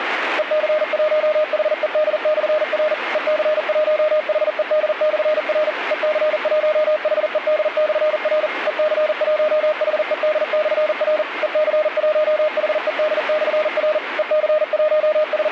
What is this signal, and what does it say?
Morse code, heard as a keyed tone, machine-sent, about 40 wpm, 610 Hz, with radio static and a weaker station near 2130 Hz. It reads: EC1HED/R EC1HED/R EC1HED/R EC1HED/R EC1HED/R …